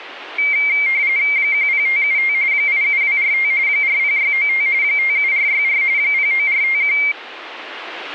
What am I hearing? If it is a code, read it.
RTTY (45.45 baud, 170 Hz shift), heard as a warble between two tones, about 2200 Hz centre. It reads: 10575 87245 40695 57464 09451